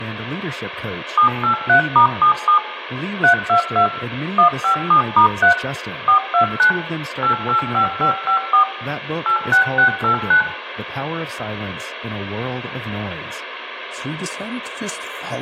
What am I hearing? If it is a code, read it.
DTMF, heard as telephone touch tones, dialled by machine, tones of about 100 ms, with room echo and speech in English. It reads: 783*77 322 157*3 429 885554 86689